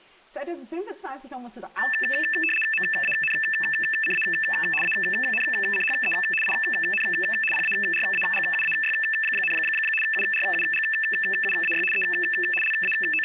RTTY (75 baud, 850 Hz shift), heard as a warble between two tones, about 2200 Hz centre. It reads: MANCA ANCHE IN PARAGUAY, URUGUAY E …